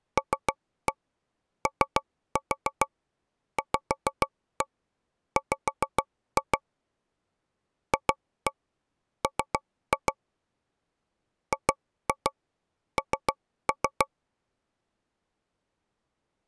Tap code, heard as taps on a table, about 6 knocks a second. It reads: LOVW FM GN